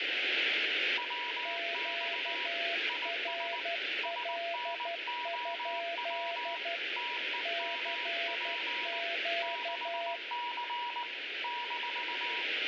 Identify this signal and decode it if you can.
Morse code, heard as two keyed tones, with radio static and room echo. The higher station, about 19 wpm, 970 Hz: WX IS SNOW TEMP 6C -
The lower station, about 12 wpm, 680 Hz: QRL? CQ